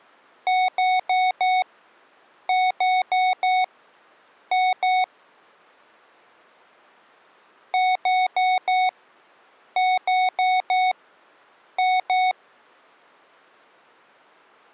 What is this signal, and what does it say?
Beep code, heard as beeps from a small speaker, played twice, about 740 Hz. 4-4-2. In Phoenix BIOS tables: parallel port failure.